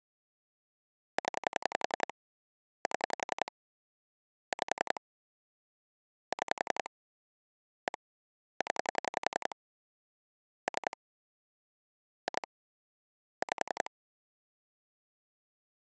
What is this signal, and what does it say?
Pulse dialling, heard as clicks on a phone line, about 11 pulses a second. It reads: 0 7 5 6 1 0 3 2 5